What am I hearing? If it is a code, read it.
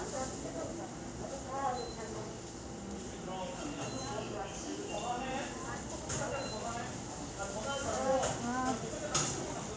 The noise of a subway station. There is no code.